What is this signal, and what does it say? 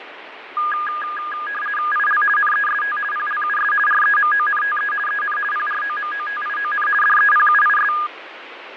RTTY (50 baud, 450 Hz shift), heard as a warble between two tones, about 1430 Hz centre, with radio static and fading. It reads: IL NEST PLUS REMONTE EN PROMOTION DEPUIS